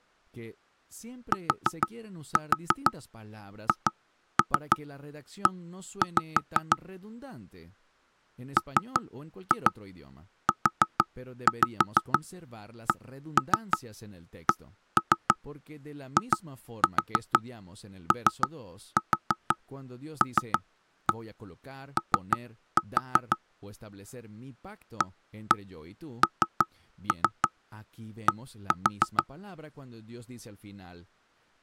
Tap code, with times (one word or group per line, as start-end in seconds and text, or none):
1.3-6.8 THE
8.6-23.4 MUCCIOLO
25.0-29.2 AND